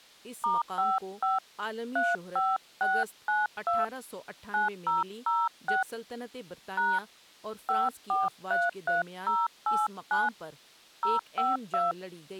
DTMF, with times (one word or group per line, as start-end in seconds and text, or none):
0.4-1.4 *55
2.0-3.8 35692
4.5-5.8 9006
6.8-7.0 #
7.7-10.3 5433089
11.0-11.9 052